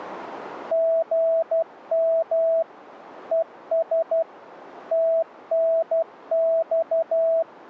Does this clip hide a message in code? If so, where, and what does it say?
Yes: Morse code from 0.7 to 7.5 s, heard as a keyed tone, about 12 wpm, 660 Hz. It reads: GM ES TNX